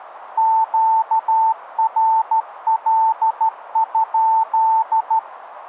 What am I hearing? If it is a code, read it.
Morse code, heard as a keyed tone, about 13 wpm, 890 Hz, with radio static. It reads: QRL?